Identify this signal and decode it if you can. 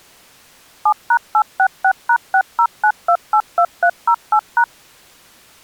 DTMF, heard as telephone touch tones, dialled by machine, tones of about 70 ms. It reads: 7#866#609282308#